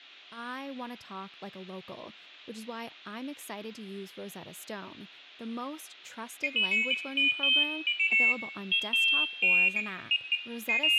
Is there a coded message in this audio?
No, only pairs of high tones at irregular times, with hum, room echo and speech in English.